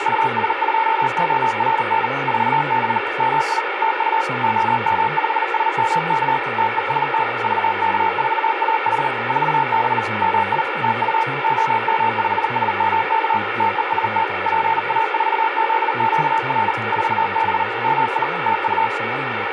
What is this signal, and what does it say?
Morse code, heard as a keyed tone, machine-sent, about 39 wpm, 900 Hz, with radio static and speech in English. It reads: US2ORN 4B MI TU OM5SMK TEST VK4AH 4B MI TU OM5SMK TEST PA4ZQR 4B MI TU